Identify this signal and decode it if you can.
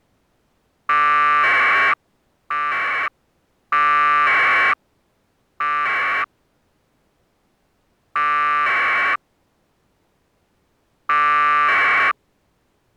Packet radio (AX.25, as in APRS), 1200 baud, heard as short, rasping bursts.